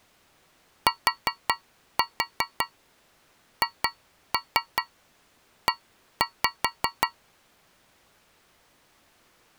Tap code, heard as taps on a metal pipe, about 5 knocks a second. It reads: THE